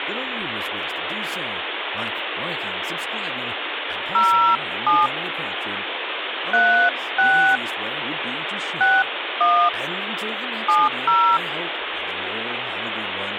DTMF, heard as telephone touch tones, dialled by hand, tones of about 300 ms, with phone line noise and speech in English. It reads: 07 36 61 70